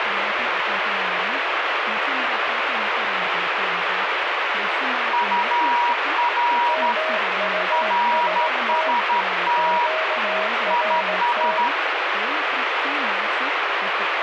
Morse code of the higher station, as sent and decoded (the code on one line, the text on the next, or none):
..- .-. / .-. ... - / .. ...
UR RST IS